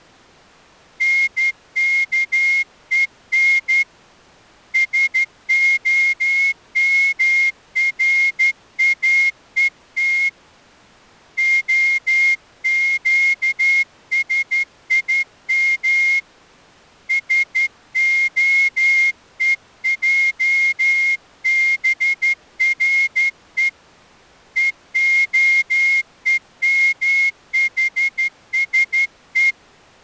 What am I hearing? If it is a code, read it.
Morse code (Hebrew alphabet), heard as a whistle, hand-sent with a straight key, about 12 wpm. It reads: נכון שהמראות הקשים שהועברו והומחשו